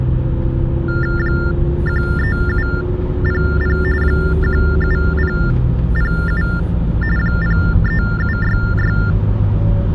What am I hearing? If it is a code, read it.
TTY/TDD text telephone tones (45.45 baud Baudot), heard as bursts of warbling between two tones, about 400 Hz shift, 1600 Hz centre, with the noise inside a car. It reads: 13700 17007 03766